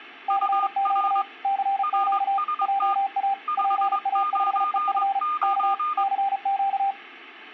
Morse code, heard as two keyed tones. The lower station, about 35 wpm, 790 Hz: CQ CQ JA PA5EF K CQ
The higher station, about 22 wpm, 1220 Hz: UR RST 599